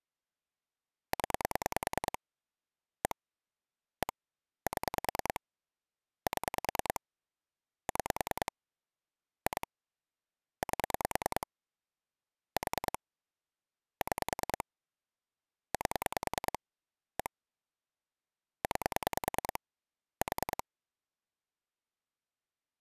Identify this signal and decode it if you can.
Pulse dialling, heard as clicks on a phone line, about 10 pulses a second. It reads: 0 1 1 7 7 6 2 8 4 6 8 1 9 4